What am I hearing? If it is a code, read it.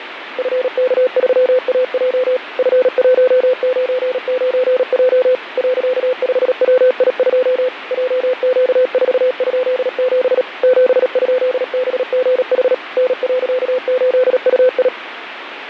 Morse code, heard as a keyed tone, machine-sent, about 37 wpm, 510 Hz, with radio static and fading. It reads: FK3AJ F199J .5WI2 JQ4?7 7?BGH N.8UI